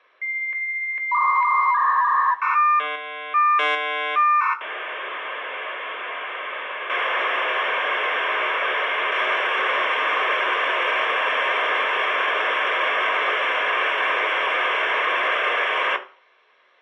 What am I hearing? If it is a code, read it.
Dial-up modem handshake (V.34 or later), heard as a whistle, warbles, then hiss, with room echo.